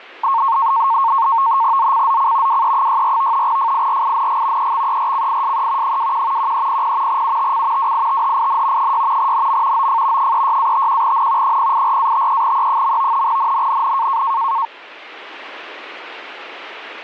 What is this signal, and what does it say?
NAVTEX (SITOR-B), 100 baud, 170 Hz shift, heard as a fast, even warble, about 1000 Hz centre. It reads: ZCZC WE64 FIRING EXERCISE 21 1300 UTC WITHIN 6 NM OF 36-51N 084-53E. NNNN